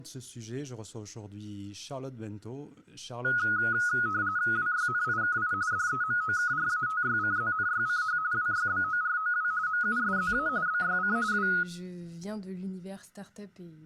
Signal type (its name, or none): RTTY